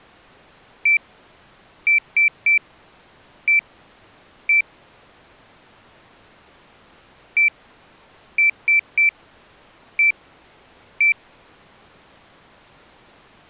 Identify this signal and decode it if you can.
Beep code, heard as a piezo beeper, played twice, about 2350 Hz. 1-3-1-1. In Phoenix BIOS tables: memory refresh test failure.